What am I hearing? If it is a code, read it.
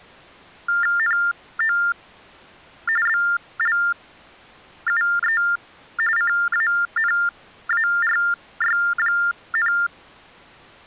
TTY/TDD text telephone tones (45.45 baud Baudot), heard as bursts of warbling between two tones, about 400 Hz shift, 1600 Hz centre. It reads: NO BLUE CANARY,